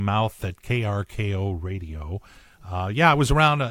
Speech in English. There is no code.